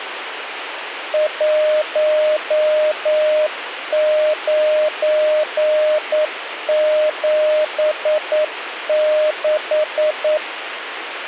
Morse code, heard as a keyed tone, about 9 wpm, 610 Hz, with radio static. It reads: 1976